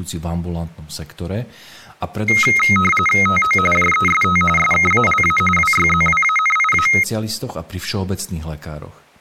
RTTY (45.45 baud, 850 Hz shift), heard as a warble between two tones, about 1700 Hz centre, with speech in Slovak. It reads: TO JEST SKALA WYZWANIA